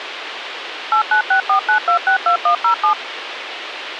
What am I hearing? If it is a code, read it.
DTMF, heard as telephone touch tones, dialled by machine, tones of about 100 ms, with radio hiss. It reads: 89649262107